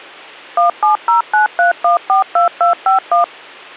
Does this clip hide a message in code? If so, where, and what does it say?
Yes: DTMF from 0.6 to 3.2 s, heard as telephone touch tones, dialled by machine, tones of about 130 ms, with hum. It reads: 17093142251